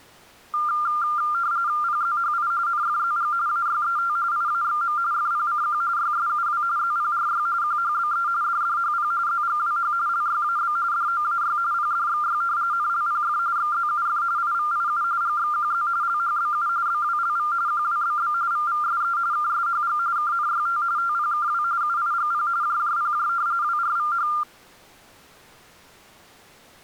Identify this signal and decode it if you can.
RTTY (45.45 baud, 170 Hz shift), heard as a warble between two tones, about 1290 Hz centre. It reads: PZHI NFZG AYET IAXM FPCQ YSUW ZPRY QHBE DDHP ZGWH LYAB DOAY PDXY NLPF XZUF IVIU GXQZ LHBU BWLV QWBB VVSE KSHG KNYT TPKW UIGP JJPJ WRVH